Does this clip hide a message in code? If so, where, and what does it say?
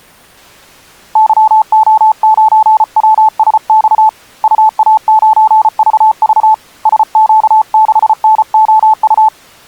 Yes: Morse code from 1.1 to 9.3 s, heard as a keyed tone, hand-sent with a paddle, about 34 wpm, 870 Hz. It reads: YO9WSX UA9VV SQ6NOU